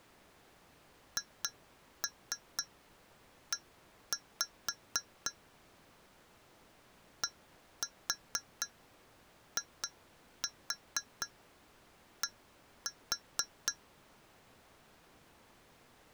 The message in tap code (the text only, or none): HE DID